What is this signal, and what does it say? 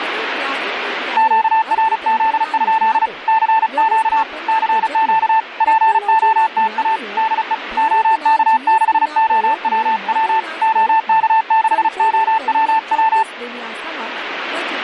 Morse code, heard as a keyed tone, hand-sent with a paddle, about 35 wpm, 890 Hz, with radio static and speech in Gujarati. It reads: QRZ? CQ CQ POTA DE OK6OWW OK6OWW